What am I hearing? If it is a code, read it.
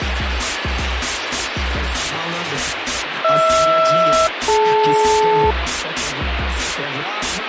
Aircraft SELCAL, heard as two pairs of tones, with radio static. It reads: HR-DL